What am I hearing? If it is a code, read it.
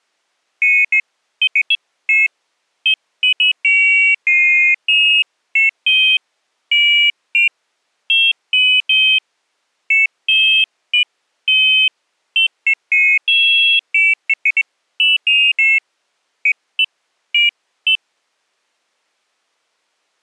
Pairs of high tones at irregular times. There is no code.